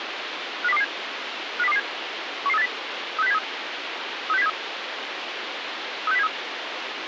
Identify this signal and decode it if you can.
Five-tone selective call (EEA), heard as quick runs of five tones, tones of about 40 ms, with radio hiss. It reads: 50227 50227 11380 36073 36073 36073